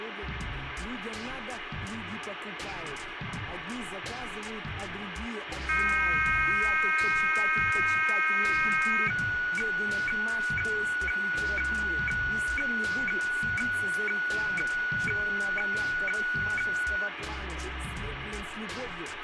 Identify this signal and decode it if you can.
Weather fax (radiofax), 120 lines a minute, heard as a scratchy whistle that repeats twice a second, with radio static.